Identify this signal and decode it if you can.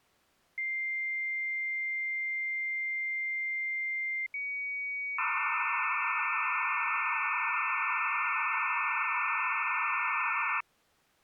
Dial-up modem handshake (low-speed, two carriers), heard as two whistles, then hiss.